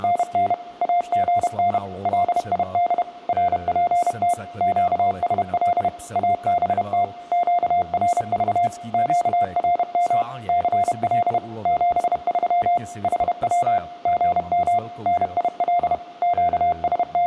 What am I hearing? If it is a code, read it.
Morse code, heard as a keyed tone, machine-sent, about 31 wpm, 700 Hz, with room echo and speech in Czech. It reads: … AGN LID RPT QSL ABT QRV QRM CL 73 HW GM NIL …